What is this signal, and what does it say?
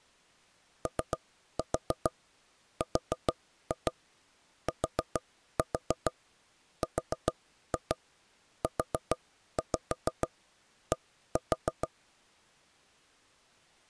Tap code, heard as knocks on wood, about 6 knocks a second. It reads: ORTRUD